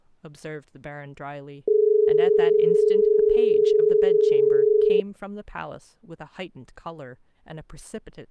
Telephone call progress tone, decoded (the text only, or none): dial tone